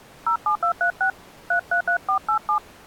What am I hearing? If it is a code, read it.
DTMF, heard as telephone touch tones, dialled by hand, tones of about 90 ms. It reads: 07236 333487